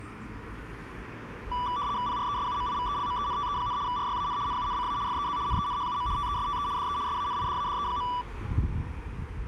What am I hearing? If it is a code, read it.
RTTY (75 baud, 170 Hz shift), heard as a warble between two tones, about 1070 Hz centre, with street noise. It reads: PRESUMIVELMENTE, RYAN NUNCA FEZ NENHUM TESTE DE SANIDADE.